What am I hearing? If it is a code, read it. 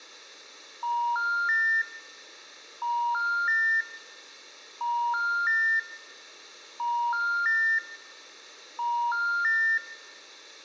Telephone call progress tone (ITU plan), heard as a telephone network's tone, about 950, 1400, 1800 Hz, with room echo. Special information tone.